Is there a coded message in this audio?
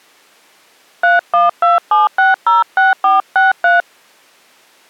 Yes: DTMF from 1.0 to 3.8 s, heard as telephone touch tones, dialled by hand, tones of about 160 ms. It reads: 3127606463